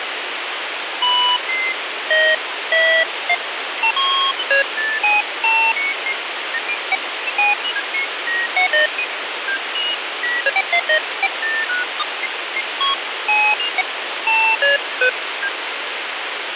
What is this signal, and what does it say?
Electronic bleeps of random pitch and length, with radio hiss. There is no code.